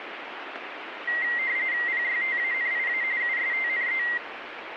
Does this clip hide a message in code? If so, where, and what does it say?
Yes: RTTY (45.45 baud, 170 Hz shift) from 1.1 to 4.2 s, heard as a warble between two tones, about 2000 Hz centre, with radio static. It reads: PYTANIA USTNE